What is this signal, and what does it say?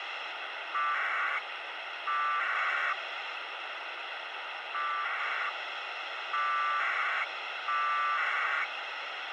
Packet radio (AX.25, as in APRS), 1200 baud, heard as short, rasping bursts, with radio hiss.